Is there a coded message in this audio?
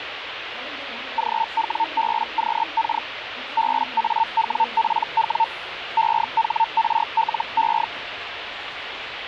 Yes: Hellschreiber (Feld-Hell, 122.5 baud) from 1.2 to 7.8 s, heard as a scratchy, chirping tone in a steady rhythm, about 900 Hz, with radio static and the noise of a subway station. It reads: GWBQK BAWPW EHRLE